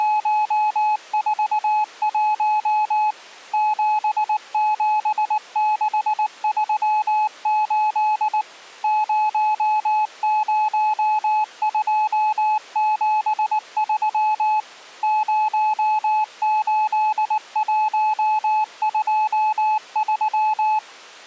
Morse code, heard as a keyed tone, machine-sent, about 19 wpm, 860 Hz. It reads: … 77638 00273 08123